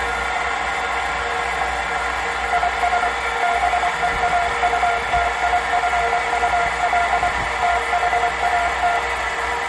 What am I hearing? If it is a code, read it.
Morse code, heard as a keyed tone, machine-sent, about 24 wpm, 700 Hz, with room echo and the noise of a restroom. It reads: IS BEAUTIFUL THAT